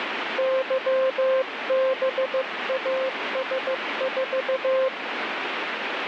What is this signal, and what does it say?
Morse code, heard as a keyed tone, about 15 wpm, 530 Hz, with radio static. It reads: YBAS4